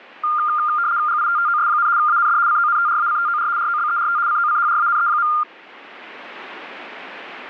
RTTY (75 baud, 170 Hz shift), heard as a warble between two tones, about 1300 Hz centre. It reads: GITTOS, AND CONTRACTOR ROBERT COCHRANE.